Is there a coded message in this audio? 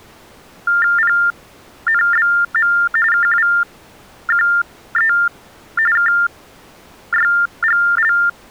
Yes: TTY/TDD text telephone tones (45.45 baud Baudot) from 0.7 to 8.3 s, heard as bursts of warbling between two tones, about 400 Hz shift, 1600 Hz centre. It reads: PNBM KWQE KYGL